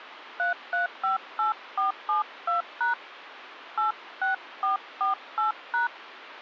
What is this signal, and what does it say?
DTMF, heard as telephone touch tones, dialled by hand, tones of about 130 ms, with phone line noise. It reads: 3358472# 86448#